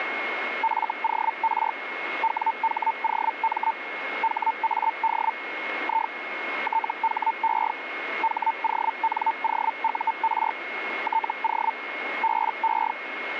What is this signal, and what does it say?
Hellschreiber (Feld-Hell, 122.5 baud), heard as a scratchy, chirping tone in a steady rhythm, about 900 Hz, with radio static and a steady whistle near 2160 Hz. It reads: FOR WHOM HAD I THE HONOUR TO BE